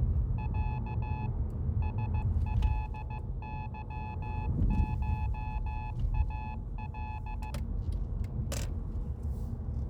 Morse code (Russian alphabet), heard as a keyed tone, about 15 wpm, 860 Hz, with room echo and the noise inside a car. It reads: Я СЛЫШАЛ